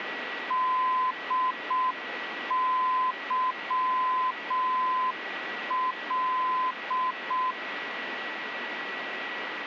Morse code, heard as a keyed tone, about 6 wpm, 1020 Hz, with radio static and a steady whistle near 1940 Hz. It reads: DYL